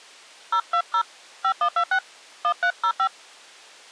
DTMF, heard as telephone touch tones, dialled by hand, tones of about 80 ms. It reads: 020 5126 1305